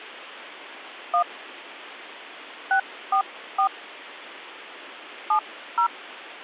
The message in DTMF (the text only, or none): 1 644 70